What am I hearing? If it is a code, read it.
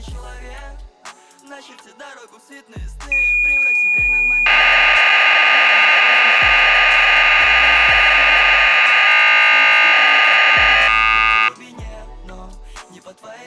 Cassette data (Kansas City type), 1200 baud, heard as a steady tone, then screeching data.